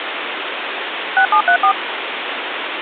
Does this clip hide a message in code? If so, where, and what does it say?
Yes: DTMF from 1.2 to 1.7 s, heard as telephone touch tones, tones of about 90 ms, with phone line noise. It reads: 6734